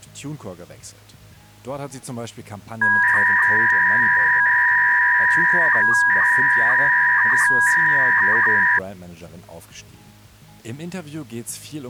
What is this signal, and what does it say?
300-baud modem data (V.21 tones), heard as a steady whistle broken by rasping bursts, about 300 baud, 200 Hz shift.